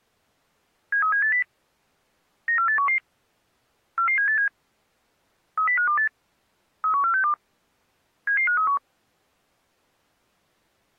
Five-tone selective call (CCIR), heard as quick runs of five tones, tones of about 100 ms. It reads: 73780 94811 44787 30528 31462 77531